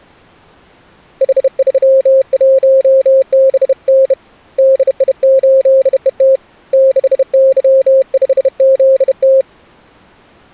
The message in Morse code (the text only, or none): H31BN DI8ET 6Y5ZT